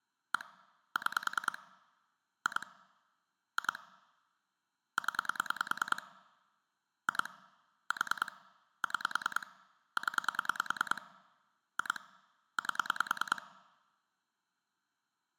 Pulse dialling, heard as clicks on a phone line, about 10 pulses a second. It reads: 1 6 2 2 0 2 4 6 0 2 8